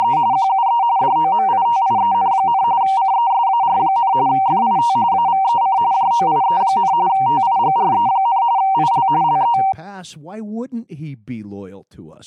RTTY (45.45 baud, 170 Hz shift), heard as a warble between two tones, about 860 Hz centre, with speech in English. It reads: … QUE DOMITIEN, CESAR, FIT AVEC JOIE, TIGRE, IL LE